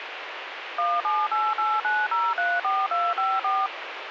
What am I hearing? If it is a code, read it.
DTMF, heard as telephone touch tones, dialled by machine, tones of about 220 ms, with radio hiss. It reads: 17889034254